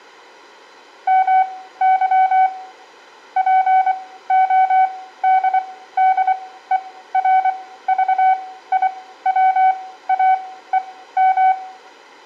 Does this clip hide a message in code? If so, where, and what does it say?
Yes: Morse code (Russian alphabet) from 1.0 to 11.6 s, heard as a keyed tone, machine-sent, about 24 wpm, spaced as for 15 wpm, 750 Hz, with room echo. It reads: МЫ ПОДДЕРЖИВАЕМ